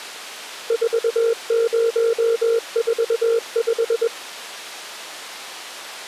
Morse code, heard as a keyed tone, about 21 wpm, 460 Hz. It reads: 4045